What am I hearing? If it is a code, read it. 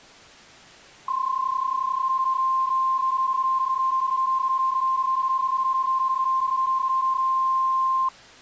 PSK31 (31.25 baud), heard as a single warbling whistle, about 1050 Hz.